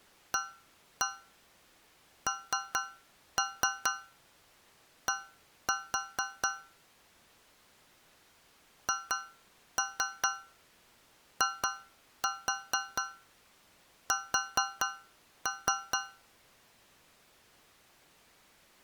Tap code, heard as taps on a metal pipe, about 4 knocks a second. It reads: AND HIS